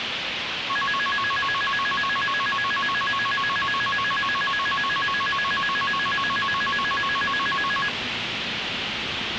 A tone that alternates evenly between two pitches, with radio hiss and the noise of a subway station. There is no code.